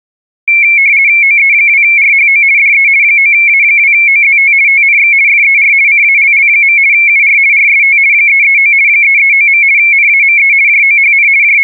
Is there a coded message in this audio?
Yes: RTTY (50 baud, 170 Hz shift) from 0.5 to 11.6 s, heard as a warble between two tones, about 2250 Hz centre. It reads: OE2RHO DE 9A2OZT TNX FER CALL. UR RST 339 339. NAME JOHN …